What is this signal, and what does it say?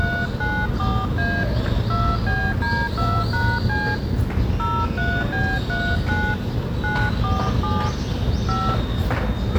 DTMF, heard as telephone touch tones, dialled by hand, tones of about 260 ms, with room echo and the noise of a residential street. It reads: 394A 2BD2#C 03B39 947 5